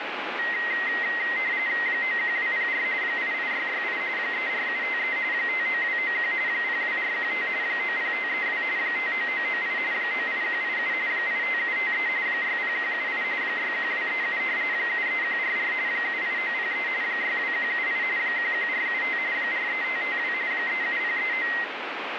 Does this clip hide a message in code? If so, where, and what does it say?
Yes: RTTY (45.45 baud, 170 Hz shift) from 0.4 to 21.6 s, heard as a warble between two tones, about 2000 Hz centre, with radio static. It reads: 91204 88668 34753 59291 02415 90532 59998 98187 85753 60178 61237 73144 78903 62178 11475 43552 37039